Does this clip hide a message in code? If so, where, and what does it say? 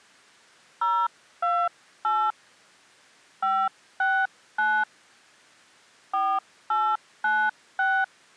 Yes: DTMF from 0.8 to 8.0 s, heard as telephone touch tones, dialled by hand, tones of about 260 ms. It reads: 028 569 4896